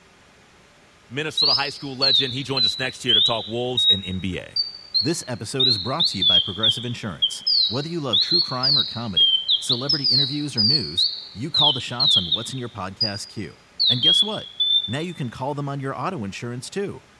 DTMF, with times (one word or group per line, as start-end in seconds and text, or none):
none